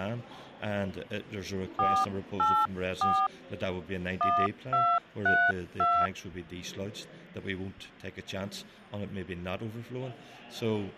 DTMF, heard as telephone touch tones, dialled by hand, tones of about 260 ms, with hum. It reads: 484 1232